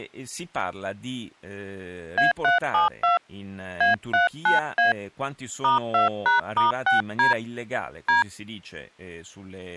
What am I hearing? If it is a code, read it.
DTMF, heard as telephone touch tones, dialled by hand, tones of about 140 ms, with speech in Italian. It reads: A372 A39A *2#*6D D